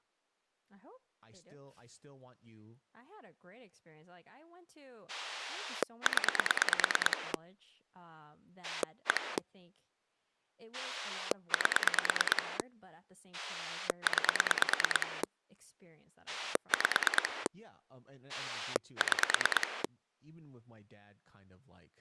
Pulse dialling, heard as a rotary dial, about 9 pulses a second, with speech in English. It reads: 0 1 8 9 5 6